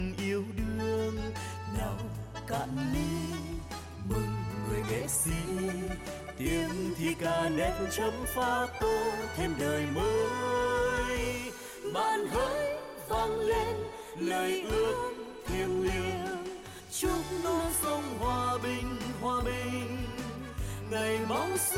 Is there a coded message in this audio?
No.